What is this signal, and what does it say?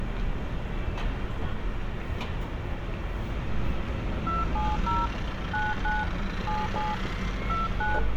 DTMF, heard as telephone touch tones, dialled by hand, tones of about 190 ms, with phone line noise and street noise. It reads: 270 99 77 29